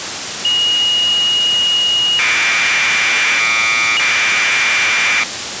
Commodore tape loading (standard loader), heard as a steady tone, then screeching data, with tape hiss.